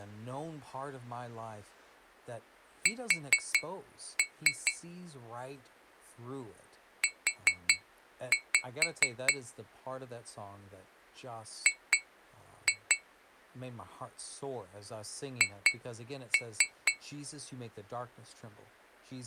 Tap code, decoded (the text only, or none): S U G H